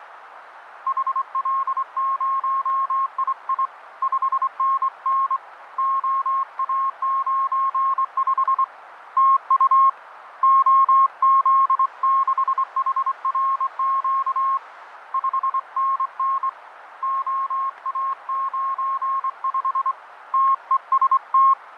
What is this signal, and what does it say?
Morse code, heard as a keyed tone, hand-sent with a straight key, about 24 wpm, 1080 Hz, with radio static and fading. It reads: HL0II 5NN OA95 TU OZ6HRQ 5NN OA95 TEST